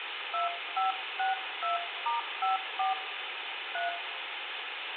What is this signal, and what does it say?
DTMF, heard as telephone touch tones, dialled by hand, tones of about 140 ms, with phone line noise and room echo. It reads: 2562*54 3